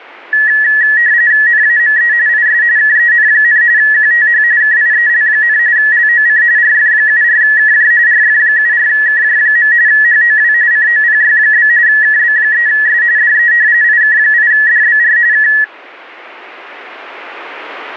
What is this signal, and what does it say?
RTTY (45.45 baud, 170 Hz shift), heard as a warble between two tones, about 1800 Hz centre. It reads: NAME IS KEN, QTH KIEL, LOC RF74KJ RF74KJ. HOW COPY? KB3S DE IK8DBR K